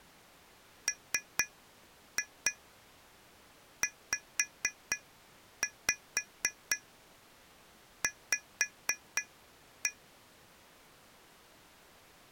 Tap code, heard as taps on glass, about 4 knocks a second. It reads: MZV